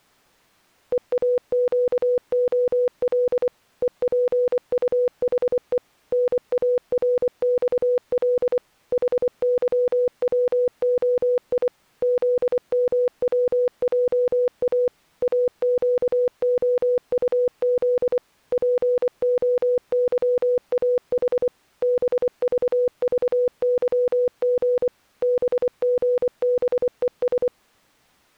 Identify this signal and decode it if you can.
Morse code, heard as a keyed tone, machine-sent, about 24 wpm, 490 Hz. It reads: EAQOL EPUHE NARXL HYWOI ZMWJA AQOUZ POYAH BVVYG BGBES